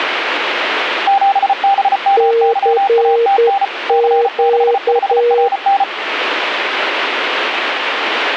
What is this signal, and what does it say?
Morse code, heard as two keyed tones, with radio static. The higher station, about 34 wpm, 790 Hz: 7BMYATN C65RN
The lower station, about 10 wpm, 470 Hz: CQ